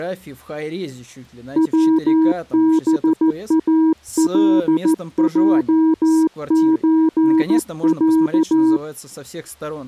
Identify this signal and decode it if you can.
Morse code (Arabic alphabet), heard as a keyed tone, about 14 wpm, 320 Hz, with speech in Russian. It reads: وبالجزع